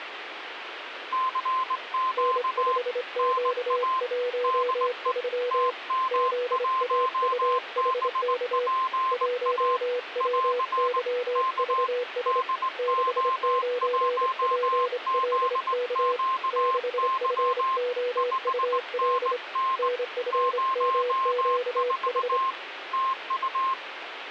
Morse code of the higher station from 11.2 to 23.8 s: K DO1ZQY 5NN 04 TU

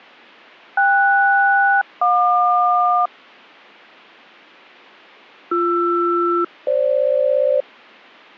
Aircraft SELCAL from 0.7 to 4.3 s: KS-JQ

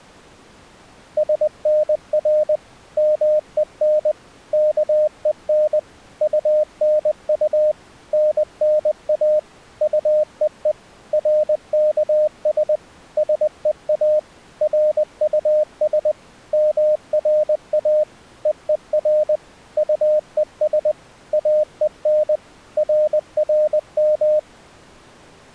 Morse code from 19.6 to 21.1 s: UES

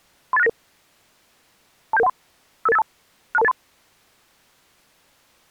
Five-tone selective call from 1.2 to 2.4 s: 27713

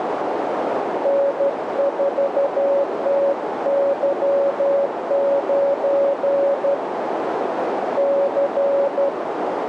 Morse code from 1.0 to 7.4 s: N4TY9

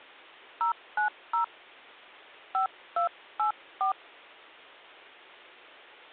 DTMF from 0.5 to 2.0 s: 090

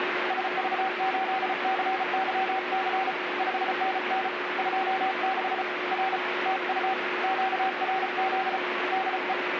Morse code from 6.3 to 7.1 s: TU

